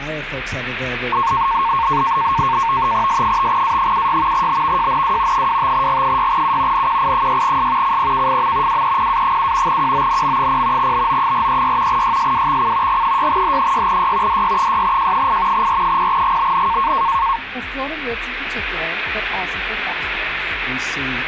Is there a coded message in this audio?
Yes: NAVTEX (SITOR-B), 100 baud, 170 Hz shift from 1.1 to 17.4 s, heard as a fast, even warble, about 1000 Hz centre. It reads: S5A76 BVJNW 25G6U NQI6S CPKFM WEPA7 QONM0 BO436 YSWXC G6H6Y DY6J8 R0GBN